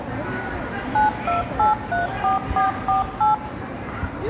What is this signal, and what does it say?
DTMF, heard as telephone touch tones, dialled by machine, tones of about 140 ms, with the noise of a park. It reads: 92834448